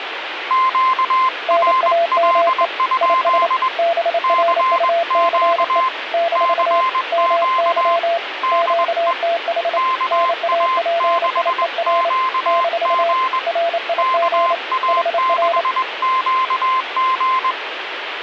Morse code, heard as two keyed tones, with radio static. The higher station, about 21 wpm, 1040 Hz: QRL? CQ CQ DE KA6QG KA6QG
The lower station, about 28 wpm, 680 Hz: NAME IS BRUCE - MY QTH NAPIER - RIG HR